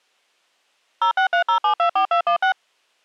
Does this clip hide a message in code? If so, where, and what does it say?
Yes: DTMF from 1.0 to 2.5 s, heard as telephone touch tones, dialled by machine, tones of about 100 ms. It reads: 0630724216